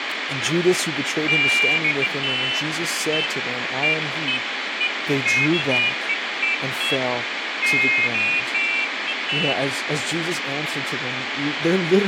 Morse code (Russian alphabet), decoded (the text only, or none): none